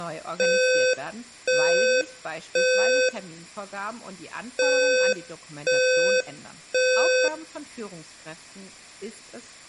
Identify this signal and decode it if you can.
Alarm pattern, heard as an alarm's beeps, played twice, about 510 Hz, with room echo and speech in German. Temporal three. Smoke or fire, evacuate.